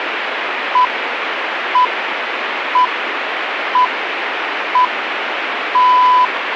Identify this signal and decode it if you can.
Radio time signal (six pips, as the Greenwich Time Signal), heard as pips, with radio static.